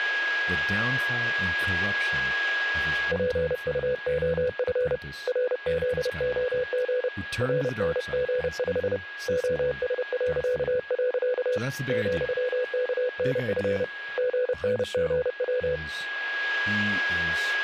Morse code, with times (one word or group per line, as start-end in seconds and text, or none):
3.1-5.0 PUOF
5.3-7.1 RZOG
7.4-9.0 RNG5
9.3-11.6 OS..
11.9-13.8 ,KNF
14.2-15.8 GNGW